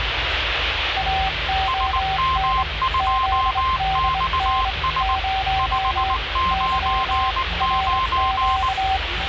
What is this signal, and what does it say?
Morse code, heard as two keyed tones, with radio static and the noise inside a car. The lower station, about 23 wpm, 770 Hz: AON ZDN 0 Y RQ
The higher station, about 19 wpm, 1050 Hz: SM2XS 599